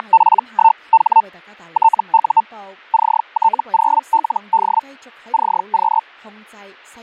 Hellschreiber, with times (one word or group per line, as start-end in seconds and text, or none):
0.0-1.2 …
1.7-2.4 TU
2.9-4.8 CT0LD
5.3-6.0 CQ